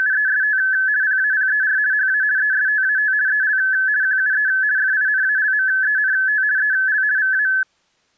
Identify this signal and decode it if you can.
RTTY (50 baud, 170 Hz shift), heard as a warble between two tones, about 1600 Hz centre. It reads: … PAPER HA ESTAT EL QUE FINALMENT EL VA